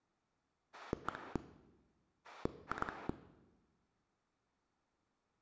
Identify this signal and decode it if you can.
Pulse dialling, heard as a rotary dial, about 9 pulses a second, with room echo. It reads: 1 2